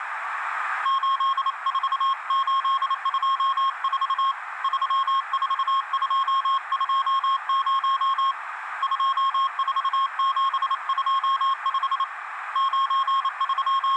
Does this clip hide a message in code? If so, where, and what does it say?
Yes: Morse code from 0.8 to 14.0 s, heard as a keyed tone, hand-sent with a paddle, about 28 wpm, 1080 Hz, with radio static, a narrow filter and room echo. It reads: 84824 34220 24725 …